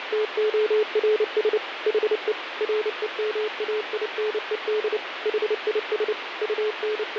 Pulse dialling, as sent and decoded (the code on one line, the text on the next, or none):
none